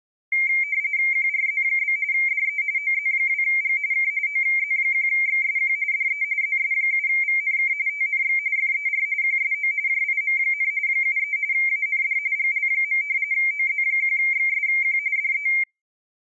RTTY (45.45 baud, 170 Hz shift), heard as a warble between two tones, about 2200 Hz centre. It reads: QRZ? DE OZ2G K OZ1XSQ DE ZS7VNK TNX FER QSO JIM, 73 AND GL. OZ1XSQ DE